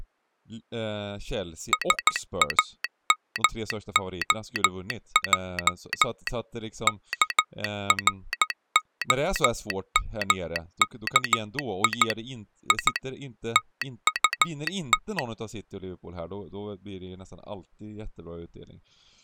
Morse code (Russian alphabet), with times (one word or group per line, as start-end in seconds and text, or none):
1.7-6.3 САМОЙ
6.9-12.1 КРОМКИ
12.7-13.0 И
13.6-15.2 ТУТ